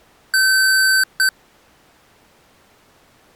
Beep code, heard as beeps from a small speaker, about 1550 Hz. 1 long, 1 short. In IBM BIOS tables: system board problem.